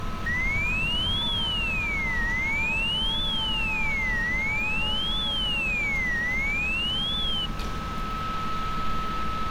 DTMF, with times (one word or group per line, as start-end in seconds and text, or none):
none